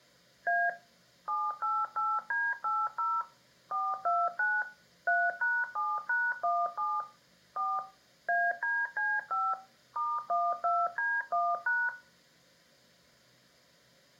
DTMF, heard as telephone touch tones, dialled by machine, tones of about 230 ms, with room echo. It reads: A 788D80 429 3#7#17 4 ADC5 *12D1#